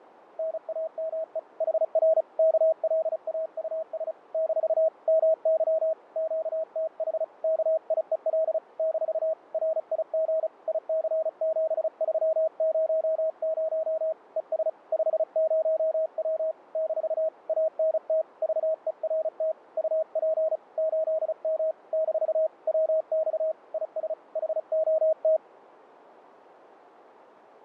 Morse code, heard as a keyed tone, hand-sent with a paddle, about 35 wpm, 640 Hz, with fading. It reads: NAME HR KLAUS - MY QTH KIEL - RIG IC7300 ES 50W - ANT VERT UP 8M - WX IS HOT